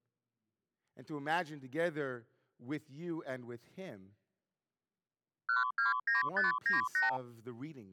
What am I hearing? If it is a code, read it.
Multi-frequency trunk signalling (R2, with the far end's replies), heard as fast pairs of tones, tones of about 150 ms, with speech in English. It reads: 129598